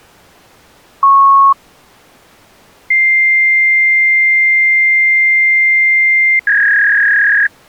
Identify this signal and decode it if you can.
Fax machine handshake, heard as a beep, a long tone and a warble.